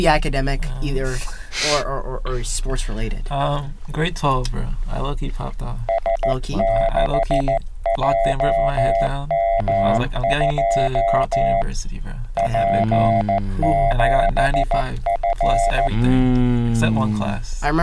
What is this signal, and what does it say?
Morse code, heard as a keyed tone, hand-sent with a paddle, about 14 wpm, 680 Hz. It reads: S6JM2 P7F